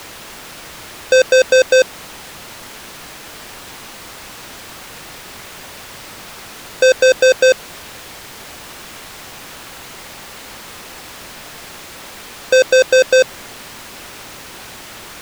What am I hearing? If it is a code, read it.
Alarm pattern, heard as an alarm's beeps, played three times, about 520 Hz. Temporal four. Carbon monoxide.